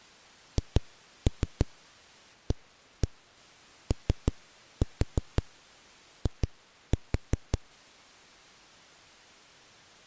Tap code, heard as knocks on a wall, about 5 knocks a second. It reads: HAOI